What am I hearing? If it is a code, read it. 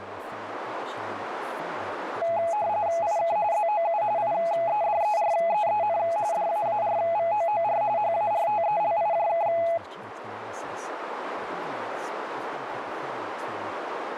RTTY (45.45 baud, 170 Hz shift), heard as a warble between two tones, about 760 Hz centre, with radio static, a narrow filter and speech in English. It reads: IK ZOU IEDEREEN DAARVOOR HARTELIJK